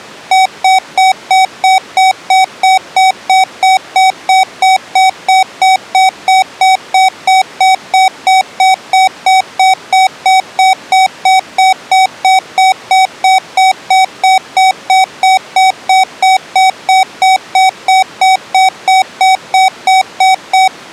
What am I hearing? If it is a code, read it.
Evenly repeated beeps. There is no code.